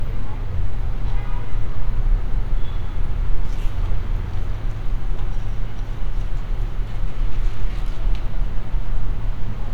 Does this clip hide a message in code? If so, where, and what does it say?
No, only street noise.